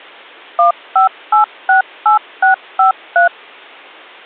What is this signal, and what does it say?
DTMF, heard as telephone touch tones, dialled by machine, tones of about 120 ms. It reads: 15868653